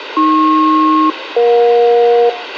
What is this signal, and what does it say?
Aircraft SELCAL, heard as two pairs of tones, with radio hiss and a squelch burst at the end. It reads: AP-EJ